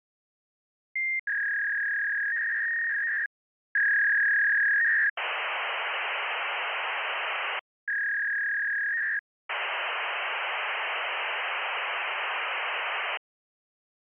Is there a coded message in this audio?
Yes: fax machine handshake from 1.0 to 13.2 s, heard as a warble and hiss.